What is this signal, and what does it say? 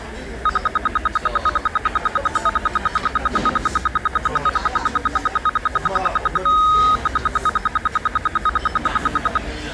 Radio time signal (RWM, Moscow), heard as ten pulses a second, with the noise of a restaurant.